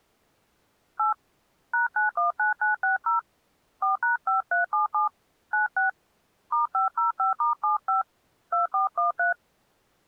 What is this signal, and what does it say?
DTMF, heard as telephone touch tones, dialled by hand, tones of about 130 ms. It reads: 8 #919960 4#5377 96 *505*75 2413